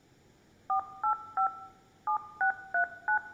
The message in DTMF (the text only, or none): 485 7639